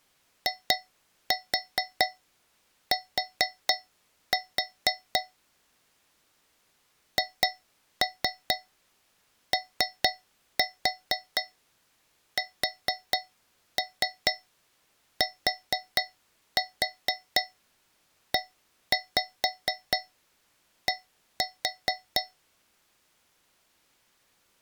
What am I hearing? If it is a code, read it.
Tap code, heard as taps on a metal pipe, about 4 knocks a second. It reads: IT HOSTED